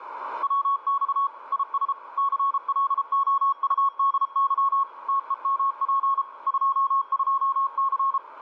Morse code, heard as a keyed tone, machine-sent, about 33 wpm, 1100 Hz, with radio static. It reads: WX IS CLOUDY TEMP 22C